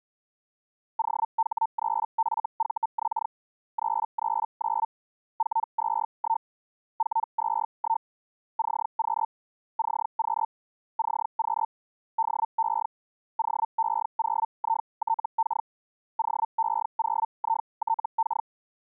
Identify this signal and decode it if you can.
Hellschreiber (Feld-Hell, 122.5 baud), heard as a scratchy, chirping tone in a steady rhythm, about 900 Hz. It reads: OH3FVX 339 421 421 CQ CQ CQ DE OE0ITK OE0ITK